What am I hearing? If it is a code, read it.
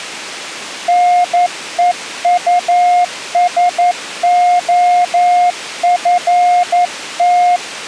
Morse code, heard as a keyed tone, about 11 wpm, 710 Hz. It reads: NEUSOFT